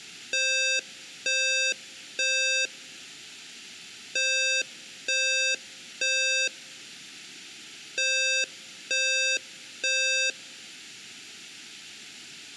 Alarm pattern, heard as an alarm's beeps, played three times, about 530 Hz, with room echo. Temporal three. Smoke or fire, evacuate.